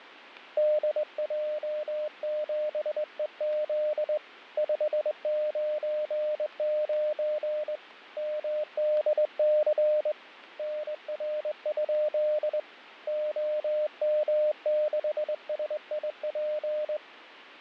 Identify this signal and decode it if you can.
Morse code, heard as a keyed tone, hand-sent with a straight key, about 21 wpm, 610 Hz, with fading. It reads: DJ7EZ 599 MDC NR? OM6SIP